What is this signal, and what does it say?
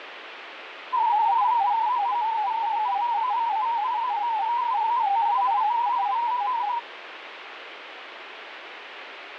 Multi-tone FSK (Olivia or MFSK type), about 250 Hz wide, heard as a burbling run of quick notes, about 31.25 baud, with radio static.